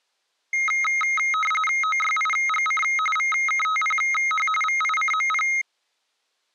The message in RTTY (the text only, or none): OYIGC VKTPH VICMP